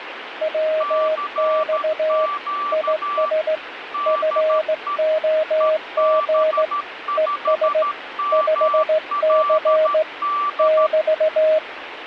Morse code, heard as two keyed tones, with radio static. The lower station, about 16 wpm, 630 Hz: WX IS FOG ES 5C <BT>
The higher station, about 13 wpm, 1160 Hz: CQ DE EB5MLD